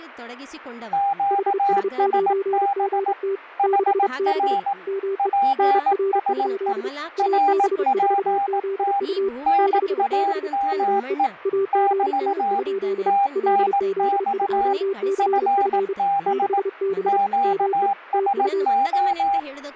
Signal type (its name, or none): Morse code